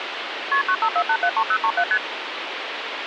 Multi-frequency trunk signalling (R1, as on North American trunks), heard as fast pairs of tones, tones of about 70 ms, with phone line noise. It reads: KP 954873037 ST